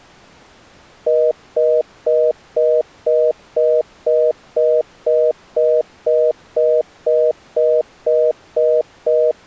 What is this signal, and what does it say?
Telephone call progress tone (North American plan), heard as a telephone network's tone, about 480, 620 Hz, 0.25 s on and 0.25 s off. Congestion tone.